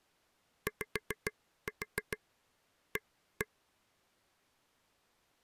Tap code, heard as taps on a table, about 6 knocks a second. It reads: YA